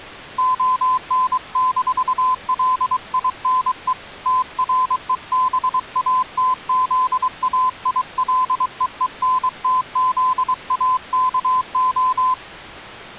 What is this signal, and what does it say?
Morse code, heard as a keyed tone, hand-sent with a paddle, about 23 wpm, 1020 Hz. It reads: ON-LINE TREBATZAILEENTZAKO